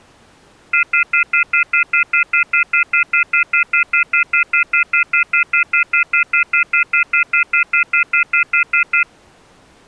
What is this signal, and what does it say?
Telephone call progress tone (North American plan), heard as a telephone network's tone, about 1400, 2050, 2450, 2600 Hz, 0.1 s on and 0.1 s off. Off-hook warning tone.